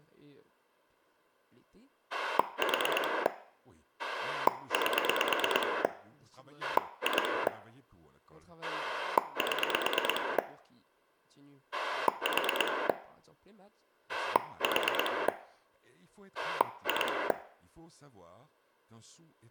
Pulse dialling, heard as a rotary dial, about 9 pulses a second, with room echo and speech in French. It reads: 4 8 2 7 4 4 2